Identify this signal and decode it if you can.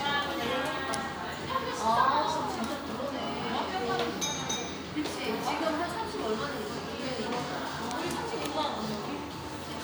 The noise of a cafe. There is no code.